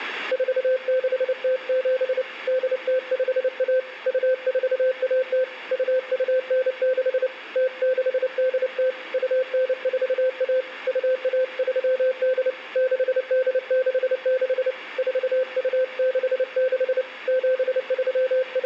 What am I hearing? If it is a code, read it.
Morse code (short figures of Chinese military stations), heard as a keyed tone, hand-sent with a paddle, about 29 wpm, 520 Hz, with room echo. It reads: 4607 8051 2410 2296 0680 2941 2138 6866 4266 …